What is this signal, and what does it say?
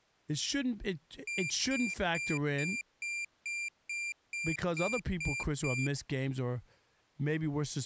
Beep code, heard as a piezo beeper, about 2400 Hz, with speech in English. 11 short. In AMI BIOS tables: cache memory error.